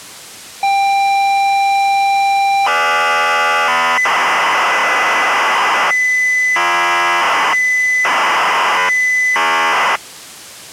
ZX Spectrum tape loading, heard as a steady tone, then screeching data.